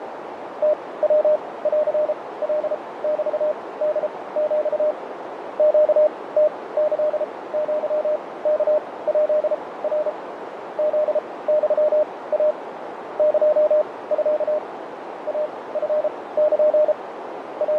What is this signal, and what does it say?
Morse code (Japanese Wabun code), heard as a keyed tone, machine-sent, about 33 wpm, spaced as for 20 wpm, 610 Hz, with radio static, fading and a narrow filter. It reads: ムヤンカメホヒ ネムキアワヱナ フユイ エミ イチル …